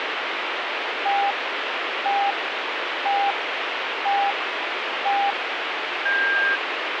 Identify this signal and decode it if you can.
Radio time signal (five pips and a higher one, as on Chinese radio), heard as pips, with radio static.